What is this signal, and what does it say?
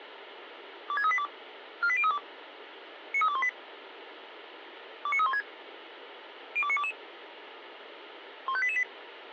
Five-tone selective call (ZVEI), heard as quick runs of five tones, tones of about 70 ms. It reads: 26382 48032 93218 29316 02922 15888